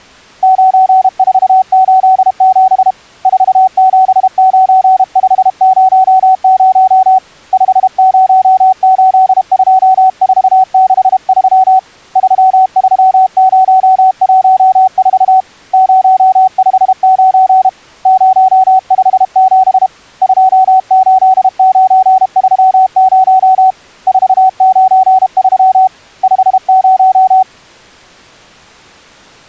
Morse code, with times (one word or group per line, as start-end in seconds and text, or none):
0.4-2.9 9487
3.3-7.2 479500
7.5-11.8 5082463
12.2-15.4 33014
15.7-17.7 059
18.1-19.9 057
20.2-23.7 28930
24.1-25.9 493
26.2-27.4 50